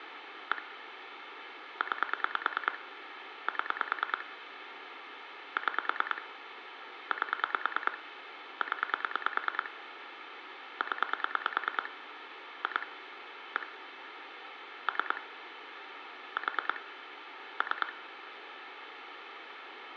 Pulse dialling, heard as clicks on a phone line, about 9 pulses a second, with phone line noise and room echo. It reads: 1 9 7 6 8 0 0 2 1 3 4 3